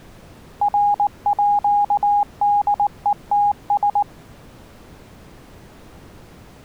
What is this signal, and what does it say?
Morse code (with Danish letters), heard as a keyed tone, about 19 wpm, 820 Hz. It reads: RÅDETS